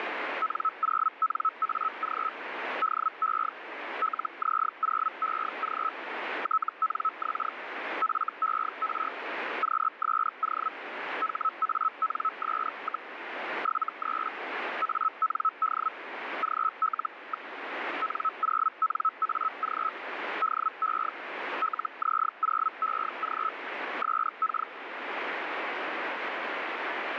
Hellschreiber (Feld-Hell, 122.5 baud), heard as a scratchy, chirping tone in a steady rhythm, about 1300 Hz, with radio static. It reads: N0NAG DE LZ0EG TNX FER QSO HANS, 73 AND GL. N0NAG DE LZ0EG SK